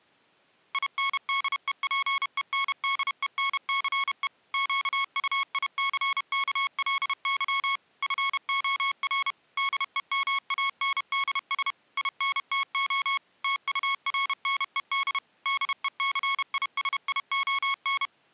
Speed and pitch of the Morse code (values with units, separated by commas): 31 wpm, 1100 Hz